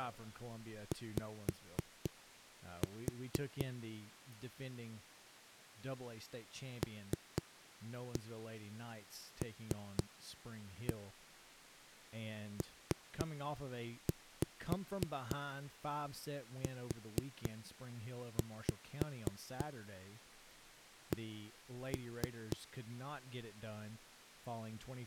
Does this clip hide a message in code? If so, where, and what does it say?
Yes: tap code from 0.9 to 22.6 s, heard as knocks on a wall, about 4 knocks a second, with speech in English. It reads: Y LLPUC